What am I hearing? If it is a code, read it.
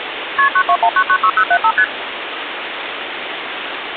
Multi-frequency trunk signalling (R1, as on North American trunks), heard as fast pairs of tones, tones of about 70 ms, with phone line noise. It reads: KP 921996075 ST